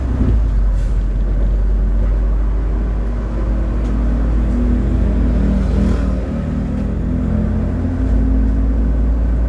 The noise inside a bus. There is no code.